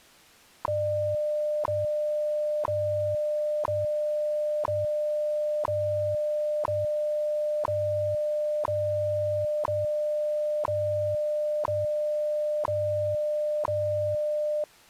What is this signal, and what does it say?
Radio time signal (WWV, Colorado), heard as ticks, one a second.